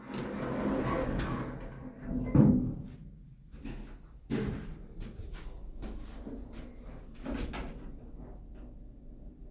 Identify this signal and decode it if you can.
The noise inside a lift. There is no code.